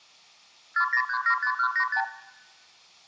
Multi-frequency trunk signalling (R2, with the far end's replies), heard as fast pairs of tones, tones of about 80 ms, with room echo. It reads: 40375185